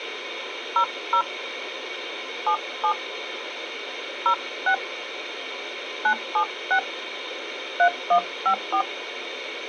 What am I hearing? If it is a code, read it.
DTMF, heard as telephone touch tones, dialled by hand, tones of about 80 ms, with radio hiss. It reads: 00 77 06 976 3154